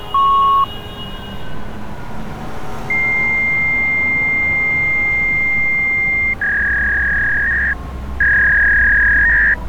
Fax machine handshake, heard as a beep, a long tone and a warble, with street noise.